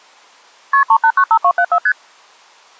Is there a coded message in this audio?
Yes: multi-frequency trunk signalling (R1, as on North American trunks) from 0.7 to 1.9 s, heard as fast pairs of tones, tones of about 70 ms. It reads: KP 3895274 ST